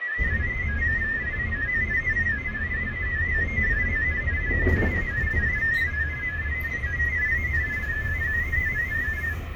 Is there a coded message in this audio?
Yes: multi-tone FSK (Olivia or MFSK type), about 500 Hz wide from 0.0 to 9.4 s, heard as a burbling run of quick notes, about 31.25 baud, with radio static and the noise inside a bus.